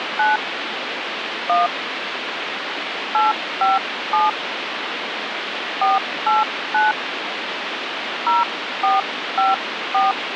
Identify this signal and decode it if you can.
DTMF, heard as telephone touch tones, dialled by hand, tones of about 170 ms, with phone line noise. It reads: 9 1 857 489 0454